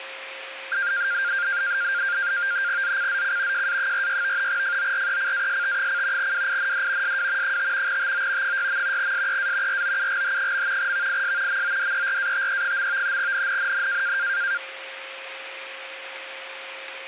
NAVTEX (SITOR-B), 100 baud, 170 Hz shift, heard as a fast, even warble, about 1500 Hz centre, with radio static and a steady whistle near 530 Hz. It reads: ZCZC JA46 FORECAST: WIND SW 5 TO 6. SEA ROUGH. VIS MODERATE. NNNN